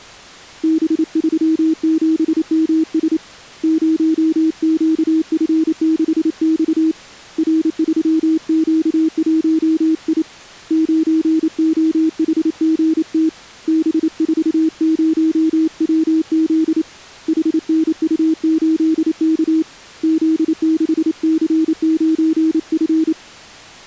Morse code, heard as a keyed tone, hand-sent with a paddle, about 28 wpm, 320 Hz. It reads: B37MS 0QF6X R3Q1I 9OHGT B40WZ HNU8K Z6C9F